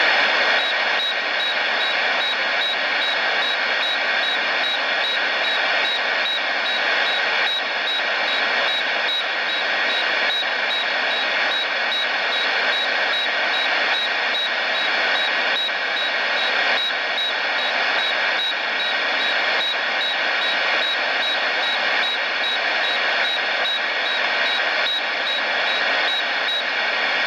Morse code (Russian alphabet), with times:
none

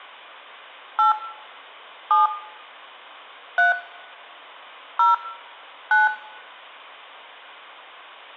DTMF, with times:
1.0-1.1 8
2.1-2.3 7
3.6-3.7 3
5.0-5.1 0
5.9-6.1 9

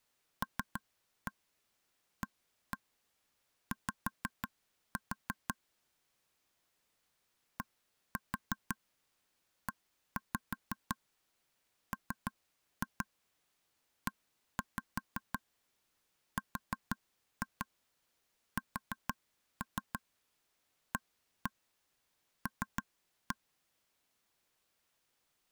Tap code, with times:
0.4-5.5 LAY
7.6-23.4 DEMERSAL

